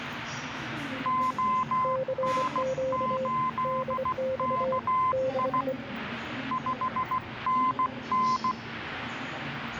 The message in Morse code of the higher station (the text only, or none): ON8KI 5NN